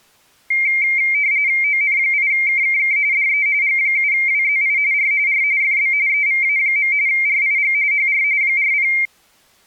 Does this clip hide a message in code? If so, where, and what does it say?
Yes: RTTY (45.45 baud, 170 Hz shift) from 0.5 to 9.1 s, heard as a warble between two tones, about 2200 Hz centre. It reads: ON8KKK DE G7WZI R R FB EVA. RIG HR 40